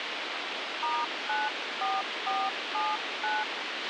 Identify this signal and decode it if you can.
DTMF, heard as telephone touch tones, dialled by hand, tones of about 190 ms, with radio hiss and a squelch burst at the end. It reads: *94479